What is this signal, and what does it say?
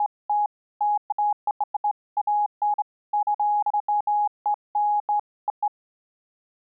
Beeps of irregular length. There is no code.